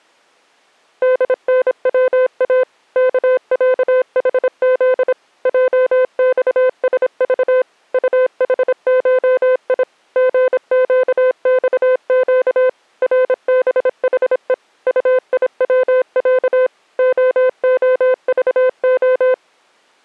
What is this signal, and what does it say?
Morse code (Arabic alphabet), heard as a keyed tone, machine-sent, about 26 wpm, 510 Hz. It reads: دنوا كعحذ جصسض طحشي غقصق ربحء طيوع خخضخ